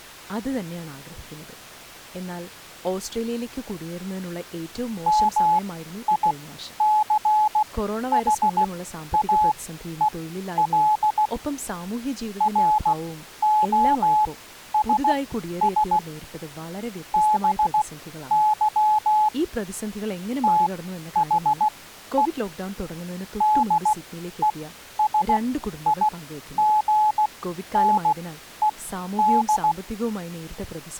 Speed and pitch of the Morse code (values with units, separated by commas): 16 wpm, spaced as for 11 wpm, 850 Hz